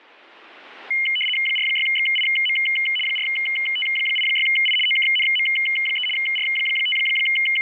RTTY (75 baud, 850 Hz shift), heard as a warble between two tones, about 2550 Hz centre. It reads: 46XIM 4T86I OKNM3 …